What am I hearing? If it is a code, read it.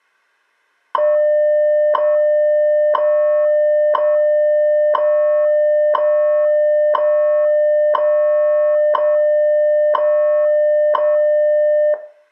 Radio time signal (WWV, Colorado), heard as ticks, one a second, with room echo.